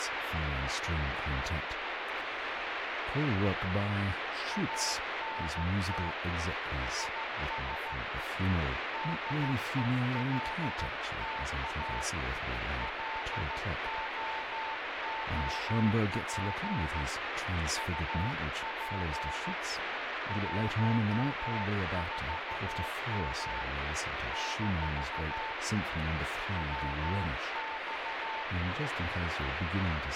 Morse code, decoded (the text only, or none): ANT IS DELTA LOOP UP 14M - WX